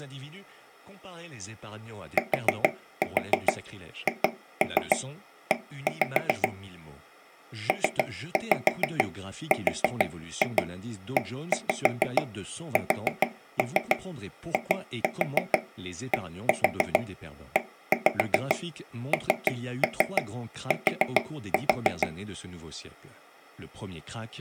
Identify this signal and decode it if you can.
Tap code, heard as taps on a table, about 6 knocks a second, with speech in French. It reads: THE PRESIDENT